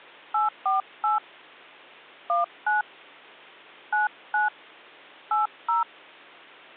DTMF, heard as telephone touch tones, dialled by hand, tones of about 150 ms. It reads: 848 19 99 80